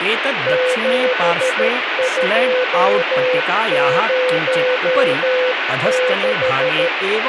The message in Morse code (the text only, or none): 7206